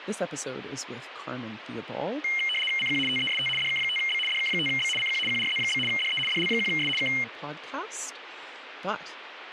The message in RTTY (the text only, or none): CQ TEST DK5B DK5B CQ QRZ? DE DL1S K